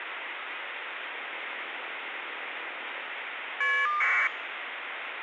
Caller ID data burst, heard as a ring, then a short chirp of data, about 1200 baud, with phone line noise.